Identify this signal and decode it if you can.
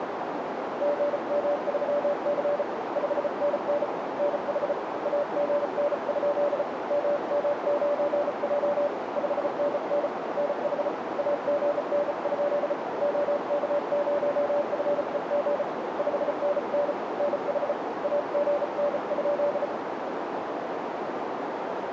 Morse code, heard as a keyed tone, hand-sent with a bug key, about 34 wpm, 580 Hz, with heavy radio static and a narrow filter. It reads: GM3C 5NN NH AGN? MM9J 5NN NH AGN? OK0FEG 5NN NH AGN?